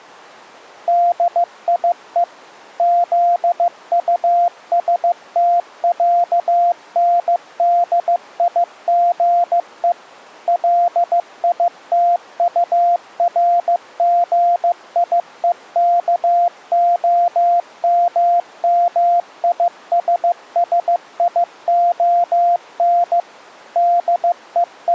Morse code (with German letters), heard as a keyed tone, machine-sent, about 15 wpm, 700 Hz. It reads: DIE ZUSTÄNDIGE LITURGIEKOMMISSION …